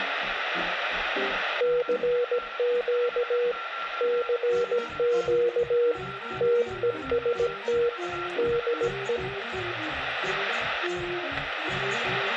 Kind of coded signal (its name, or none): Morse code